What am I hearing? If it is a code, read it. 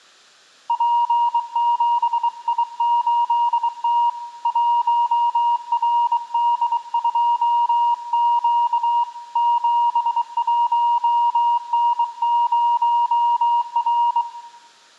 Morse code, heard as a keyed tone, hand-sent with a bug key, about 23 wpm, 950 Hz, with room echo. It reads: P7I8T 1RD2Q 71N0R